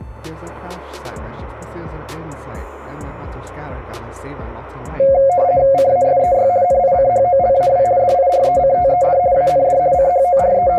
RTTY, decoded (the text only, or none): CASEY NICHOLAW DIRECTED AND …